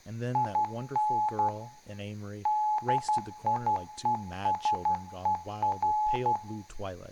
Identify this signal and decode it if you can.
Morse code, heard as a keyed tone, hand-sent with a paddle, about 12 wpm, 850 Hz, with room echo and speech in English. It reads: IN DIESER